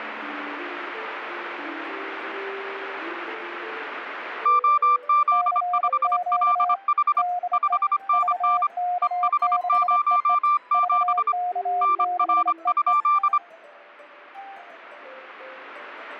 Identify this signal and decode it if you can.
Morse code, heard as two keyed tones. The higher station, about 25 wpm, 1180 Hz: OZ5LH 5NN EH07 NR?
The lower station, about 27 wpm, 720 Hz: CQ DE VK6EE VK6EE